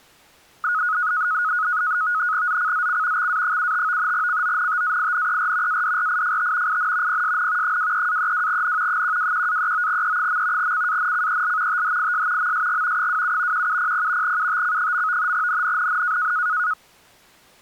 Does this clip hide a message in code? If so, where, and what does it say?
Yes: NAVTEX (SITOR-B), 100 baud, 170 Hz shift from 0.6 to 16.7 s, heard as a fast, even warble, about 1360 Hz centre. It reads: ZCZC XA75 CONTAINER ADRIFT IN PSN 23-32N 121-39E. CANCEL THIS MSG 27 1700 UTC. NNNN